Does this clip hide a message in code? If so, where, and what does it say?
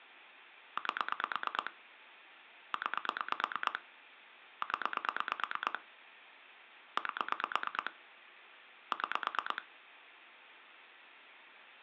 Yes: pulse dialling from 0.8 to 9.6 s, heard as clicks on a phone line, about 9 pulses a second, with phone line noise. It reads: 8 9 0 8 6